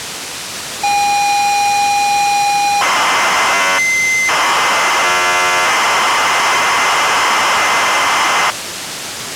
ZX Spectrum tape loading, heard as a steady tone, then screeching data, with tape hiss.